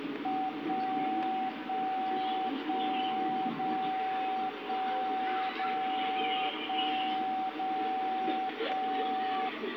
Radio time signal (DCF77), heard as a tone whose level steps once a second, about 760 Hz, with the noise of a park. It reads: 1 1 1 0 1 0 1 0 1